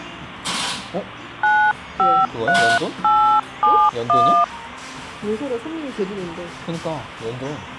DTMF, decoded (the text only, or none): 953871